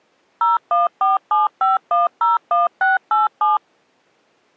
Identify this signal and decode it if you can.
DTMF, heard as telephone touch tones, dialled by machine, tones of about 160 ms. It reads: 01475101687